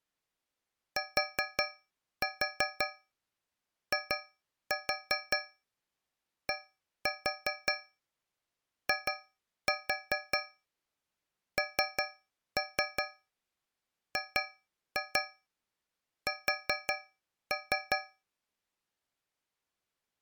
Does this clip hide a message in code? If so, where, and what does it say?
Yes: tap code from 1.0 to 18.2 s, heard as taps on a metal pipe, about 5 knocks a second. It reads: TIDINGS